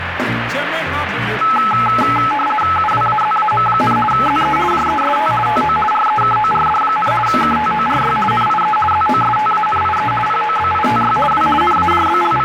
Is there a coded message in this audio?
Yes: RTTY (50 baud, 450 Hz shift) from 1.4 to 12.4 s, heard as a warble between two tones, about 1080 Hz centre, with radio static. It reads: UWAZAM, ZE JEST TO REKORD, KTORY NIE ZOSTANIE POBITY W …